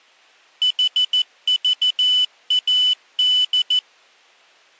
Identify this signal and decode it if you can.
Morse code, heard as a high beeper, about 14 wpm, 3000 Hz. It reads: HVAD